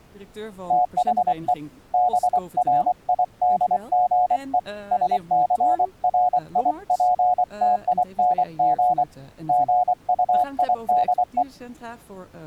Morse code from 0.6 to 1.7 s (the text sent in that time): THE